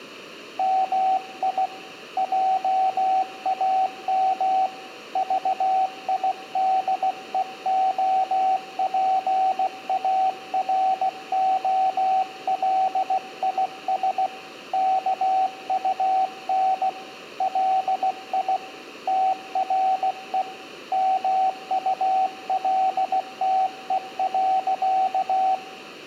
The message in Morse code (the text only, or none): MI JAM VIDEOPAROLIS KUN LI TRE MULTE.